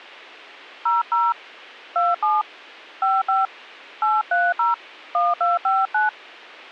DTMF, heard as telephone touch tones, dialled by hand, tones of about 170 ms, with a squelch burst at the end. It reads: 00 27 55 830 1259